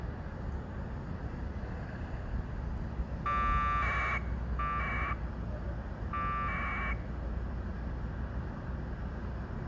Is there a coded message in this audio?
Yes: packet radio (AX.25, as in APRS), 1200 baud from 3.3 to 6.9 s, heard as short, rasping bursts, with the noise of a residential street.